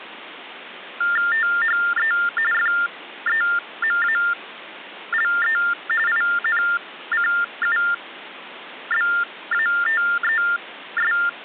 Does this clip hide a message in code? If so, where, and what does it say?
Yes: TTY/TDD text telephone tones (45.45 baud Baudot) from 1.0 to 11.3 s, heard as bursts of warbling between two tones, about 400 Hz shift, 1600 Hz centre, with phone line noise. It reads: THE FEMALE INCUBATES